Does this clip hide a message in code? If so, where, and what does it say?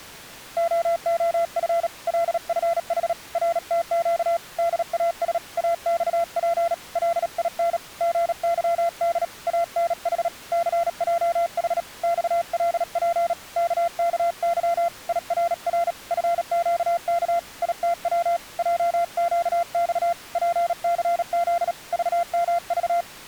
Yes: Morse code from 0.5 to 23.1 s, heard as a keyed tone, hand-sent with a paddle, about 37 wpm, 680 Hz. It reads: OOF LFH RTQ DAS AXP LIN GYD ANH CJH XLP KKY IRR FQK ITW JQX PCZ VMV